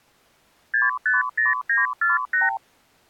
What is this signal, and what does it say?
Multi-frequency trunk signalling (R2, with the far end's replies), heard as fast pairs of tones, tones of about 160 ms. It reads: 650948